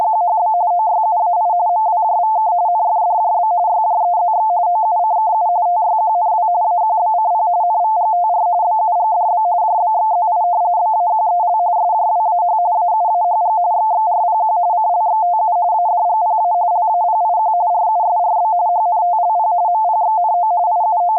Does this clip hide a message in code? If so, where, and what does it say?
Yes: RTTY (45.45 baud, 170 Hz shift) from 0.0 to 21.2 s, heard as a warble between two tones, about 790 Hz centre. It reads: … OYUAI MWJVK NFDJB YJEZX OUCKU TYQNW AQBCP NVGTR BUGDB JBXZI BAQEL SJWAH AUAHG XXRPQ CLXTU ADGPA LAPIQ RUSRB HNTLP MPXNO …